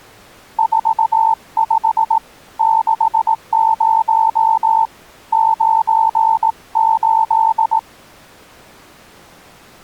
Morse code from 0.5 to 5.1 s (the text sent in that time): 45 60